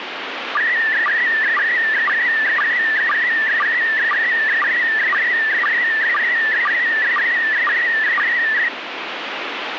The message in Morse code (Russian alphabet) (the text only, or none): none